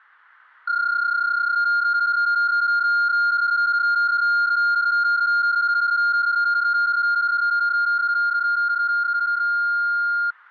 PSK31 (31.25 baud), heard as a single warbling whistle, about 1410 Hz.